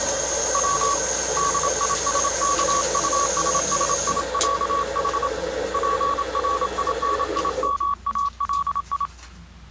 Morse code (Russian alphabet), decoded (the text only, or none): В ДИСКУССИЯХ ПРИНИМАЛИ